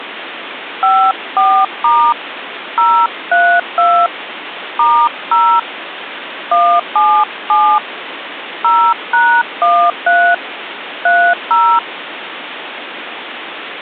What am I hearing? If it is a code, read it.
DTMF, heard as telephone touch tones, dialled by hand, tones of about 280 ms, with phone line noise. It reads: 54* 032 *0 177 0#13 30